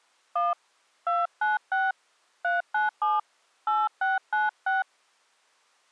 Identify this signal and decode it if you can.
DTMF, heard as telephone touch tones, dialled by hand, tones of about 180 ms. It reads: 1 296 397 8696